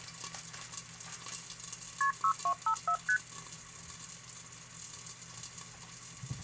Multi-frequency trunk signalling (R1, as on North American trunks), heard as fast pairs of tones, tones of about 80 ms, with kitchen noise. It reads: KP 6254 ST